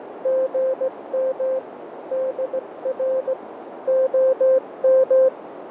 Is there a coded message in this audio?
Yes: Morse code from 0.2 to 5.3 s, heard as a keyed tone, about 17 wpm, 520 Hz, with radio static, fading and a narrow filter. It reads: GM DR OM